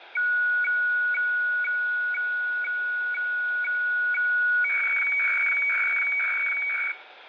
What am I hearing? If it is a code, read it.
Weather fax (radiofax), 120 lines a minute, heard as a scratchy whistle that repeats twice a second, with radio static, fading and room echo.